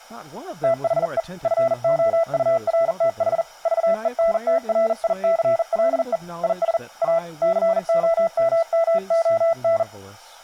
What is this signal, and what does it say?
Morse code, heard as a keyed tone, hand-sent with a bug key, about 40 wpm, 660 Hz, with speech in English. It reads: THE FOURTH VENTRICLE IS A COMMON